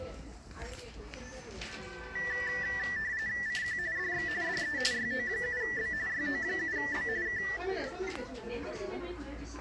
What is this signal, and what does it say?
RTTY (45.45 baud, 170 Hz shift), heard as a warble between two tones, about 1850 Hz centre, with the noise of a crowd indoors. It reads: CQ DX DE YO7B YO7B K